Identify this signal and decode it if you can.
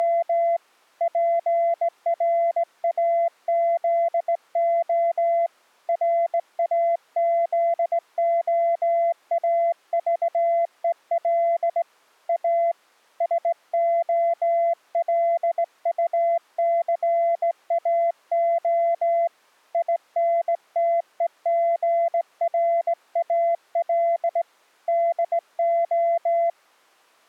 Morse code, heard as a keyed tone, hand-sent with a straight key, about 18 wpm, 680 Hz. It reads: … PRAZO RAZOAVEL A SOLUCAO INTEGRAL DO